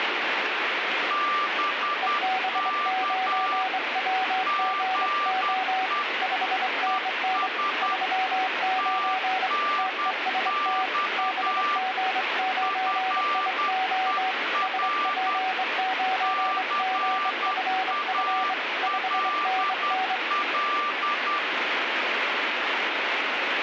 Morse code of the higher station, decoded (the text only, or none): BK GE ES TNX FER CALL